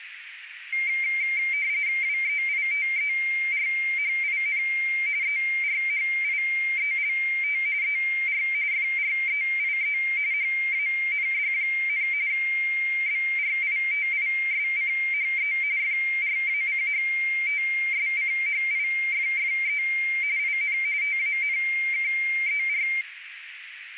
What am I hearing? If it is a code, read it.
RTTY (45.45 baud, 170 Hz shift), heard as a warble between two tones, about 2200 Hz centre, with radio static and a narrow filter. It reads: WEITERHIN ERHIELT ER FREIE HAND, BRITISCHE FRACHTSCHIFFE IN TANKER